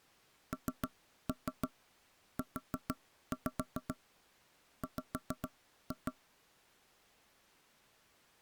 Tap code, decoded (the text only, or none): NUW